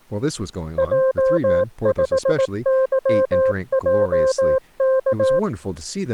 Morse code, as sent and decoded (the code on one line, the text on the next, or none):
.--- ..... -.-- .--- -.-
J5YJK